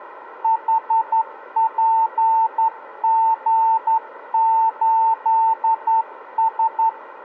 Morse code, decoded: HPG8S

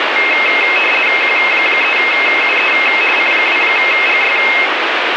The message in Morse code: none

